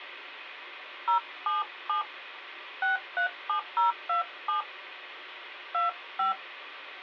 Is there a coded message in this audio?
Yes: DTMF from 1.1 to 6.3 s, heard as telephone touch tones, dialled by hand, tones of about 120 ms. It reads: 077 637027 25